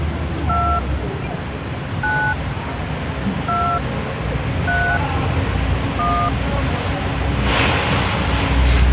DTMF, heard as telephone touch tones, dialled by hand, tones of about 300 ms, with the noise of a residential street. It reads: 2 9 2 3 1